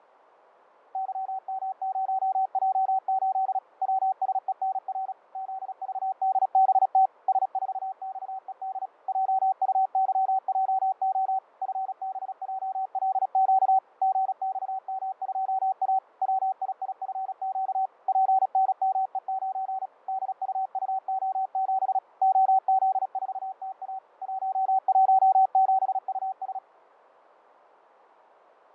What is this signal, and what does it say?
Morse code, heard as a keyed tone, machine-sent, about 36 wpm, 760 Hz, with fading. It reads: YM0J8 WSENR ZVDBT S4XED JUYJO FBJLQ GXM2A WIIFQ PNME9 DUUO7 OZ4TA 117US